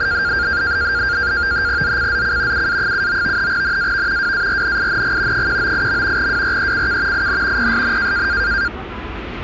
NAVTEX (SITOR-B), 100 baud, 170 Hz shift, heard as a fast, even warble, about 1500 Hz centre, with the noise of a residential street. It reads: ZCZC UA79 NAV WARNING 198. WRECK IN PSN